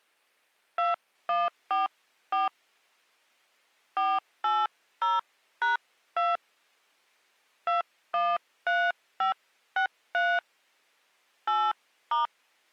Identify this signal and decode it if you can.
DTMF, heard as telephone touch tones, dialled by hand, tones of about 170 ms. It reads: 2144 480#2 213563 8*